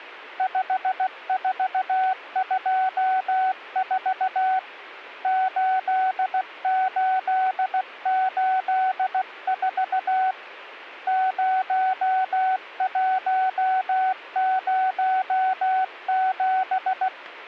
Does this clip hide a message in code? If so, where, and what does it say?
Yes: Morse code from 0.3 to 17.1 s, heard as a keyed tone, hand-sent with a paddle, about 16 wpm, 750 Hz. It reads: 5424 8884 0107